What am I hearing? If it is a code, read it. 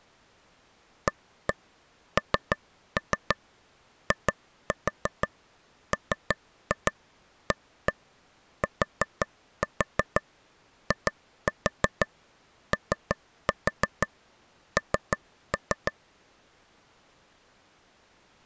Tap code, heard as taps on a table, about 6 knocks a second. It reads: ANIMATION